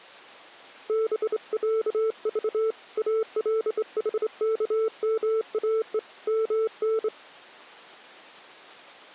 Morse code (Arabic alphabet), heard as a keyed tone, hand-sent with a straight key, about 25 wpm, 440 Hz. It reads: بعض الحكماء من